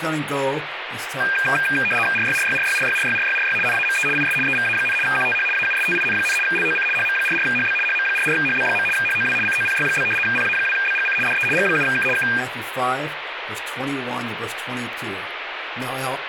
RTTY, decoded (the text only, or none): RYRYRYRYRYRYRY NAME IS EVA, QTH AUSTIN, LOC HM44HB HM44HB. HOW COPY? PA2BGC DE G7K K